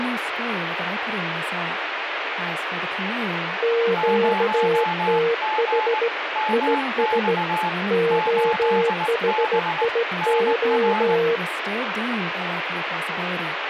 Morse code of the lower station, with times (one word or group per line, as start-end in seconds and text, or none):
3.6-6.1 QTH
6.5-7.3 IS
7.9-11.4 OHIO